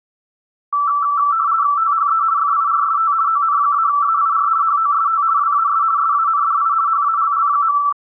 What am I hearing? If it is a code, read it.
RTTY (50 baud, 170 Hz shift), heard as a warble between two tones, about 1240 Hz centre. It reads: THE FIRST ON-AIR HOST WAS SANDI HALL.